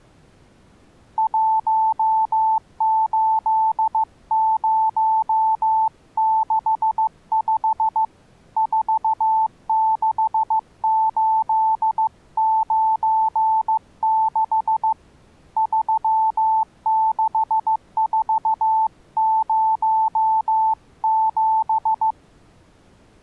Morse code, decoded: 18065 46896 36407

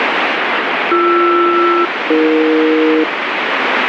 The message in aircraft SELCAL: BR-AE

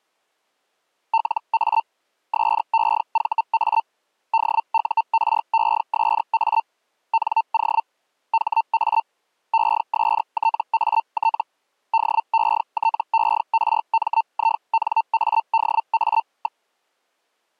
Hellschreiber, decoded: LA SEVA DURESA NO HA ESTAT DETERMINADA.

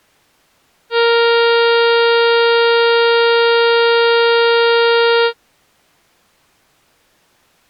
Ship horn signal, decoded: 1 long

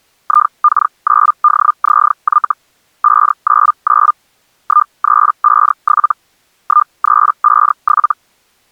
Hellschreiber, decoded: IK9DZY 599 1357 1357

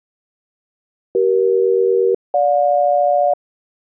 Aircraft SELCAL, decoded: CE-GJ

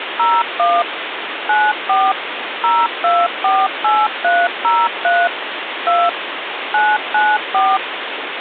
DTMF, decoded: 01 94 0248303 2 994

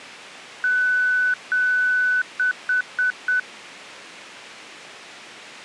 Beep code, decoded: 2 long, 4 short

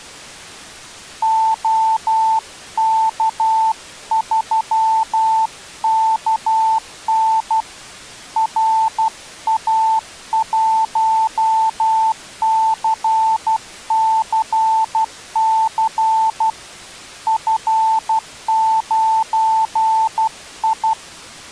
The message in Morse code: OK3KN RA1CCC F9I

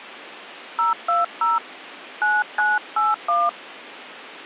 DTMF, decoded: 020 9981

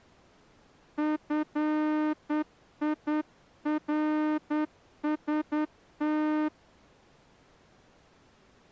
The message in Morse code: FIRST

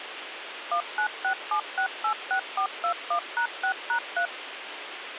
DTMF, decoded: 1967686421#6#3

